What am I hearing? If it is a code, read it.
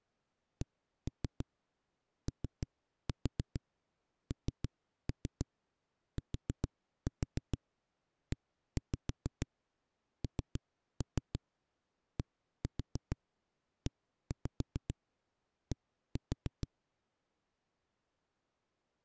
Tap code, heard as knocks on a wall, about 6 knocks a second. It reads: CONTENDED